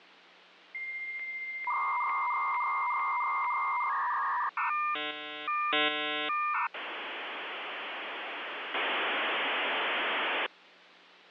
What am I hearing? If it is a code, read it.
Dial-up modem handshake (V.34 or later), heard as a whistle, warbles, then hiss.